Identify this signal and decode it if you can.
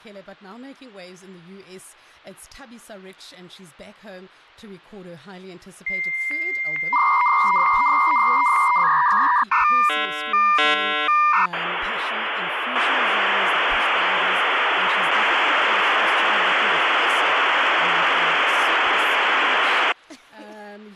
Dial-up modem handshake (V.34 or later), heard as a whistle, warbles, then hiss.